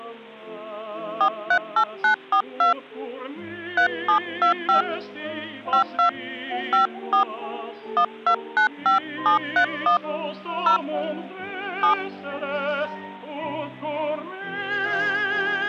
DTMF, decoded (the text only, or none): 438942 3725 52 54 1295731 0 7